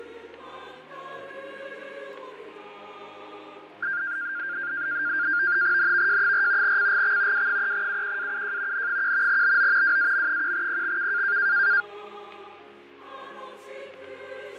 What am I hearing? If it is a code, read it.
NAVTEX (SITOR-B), 100 baud, 170 Hz shift, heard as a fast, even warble, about 1500 Hz centre, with fading. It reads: NVJ4 CGX W3UQAUJ N1 BO WAM1PXK